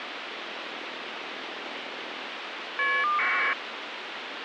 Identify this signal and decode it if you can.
Caller ID data burst, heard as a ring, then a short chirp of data, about 1200 baud, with phone line noise.